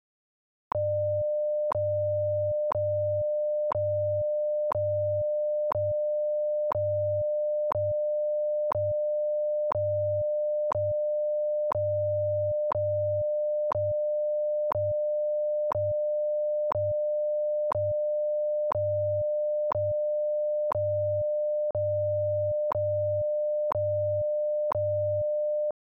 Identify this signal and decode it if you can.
Radio time signal (WWV, Colorado), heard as ticks, one a second.